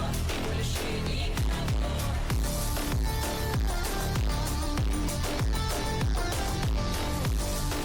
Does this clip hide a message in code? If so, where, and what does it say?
No.